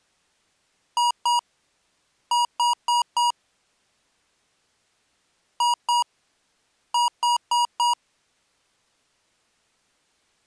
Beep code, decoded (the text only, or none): 2-4